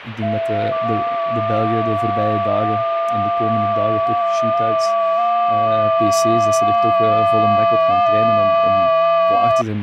FT8 (several signals at once), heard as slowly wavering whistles, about 6.25 baud, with radio static and speech in Dutch.